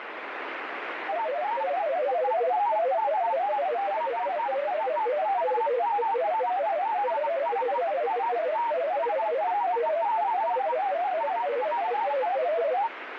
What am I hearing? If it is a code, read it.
Multi-tone FSK (Olivia or MFSK type), about 500 Hz wide, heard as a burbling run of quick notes, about 31.25 baud, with radio static.